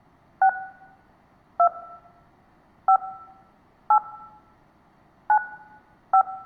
DTMF, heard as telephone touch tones, dialled by hand, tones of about 80 ms, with room echo. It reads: 6 2 5 8 9 5